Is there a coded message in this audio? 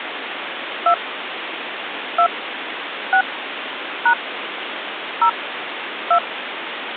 Yes: DTMF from 0.9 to 6.2 s, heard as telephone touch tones, dialled by hand, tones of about 80 ms, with phone line noise. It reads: 2 2 6 # 0 2